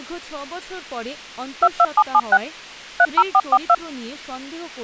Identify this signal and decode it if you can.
DTMF, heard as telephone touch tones, dialled by machine, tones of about 50 ms, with speech in Bangla. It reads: 22776 30442